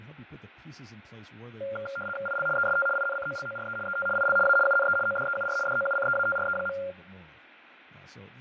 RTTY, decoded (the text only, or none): IL EST INCOLORE ET IL A UNE ODEUR DOUCEATRE.